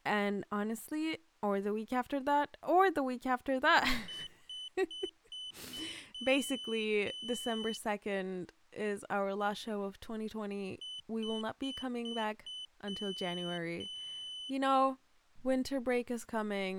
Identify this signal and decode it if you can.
Beep code, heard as a piezo beeper, played twice, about 3000 Hz, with speech in English. 5 short, 2 long.